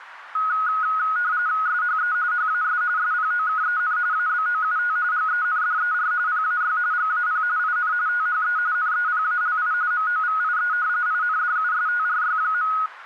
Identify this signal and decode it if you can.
RTTY (45.45 baud, 170 Hz shift), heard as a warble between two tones, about 1360 Hz centre, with radio static. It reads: SHE HAS SPOKEN ABOUT GENDER PAY GAP IN THE NEPALI MOVIE INDUSTRY.